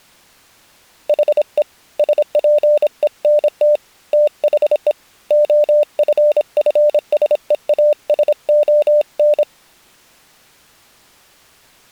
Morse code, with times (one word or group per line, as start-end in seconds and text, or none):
1.1-1.6 HE
2.0-3.8 SPENT
4.1-4.9 THE
5.3-9.4 OFFSEASON